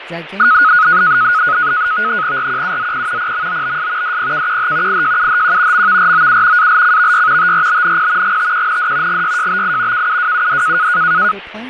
NAVTEX (SITOR-B), 100 baud, 170 Hz shift, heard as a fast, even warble, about 1360 Hz centre, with radio static, fading and speech in English. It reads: RQUZP PMOBS DPKQH IJUHQ MVROU ALCVY TRBNP GTQND GYJBI KUWUD